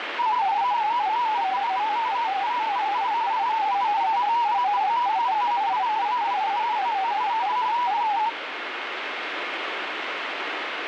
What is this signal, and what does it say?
Multi-tone FSK (Olivia or MFSK type), about 250 Hz wide, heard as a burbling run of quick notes, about 31.25 baud, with radio static.